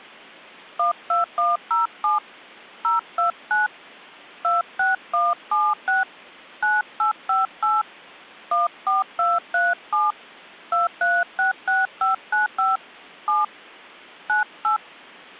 DTMF, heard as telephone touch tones, dialled by hand, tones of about 170 ms. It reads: 12107 029 26176 9858 14237 2366595 7 98